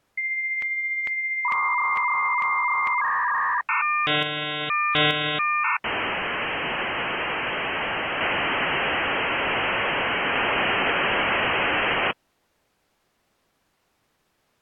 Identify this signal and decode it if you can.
Dial-up modem handshake (V.34 or later), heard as a whistle, warbles, then hiss.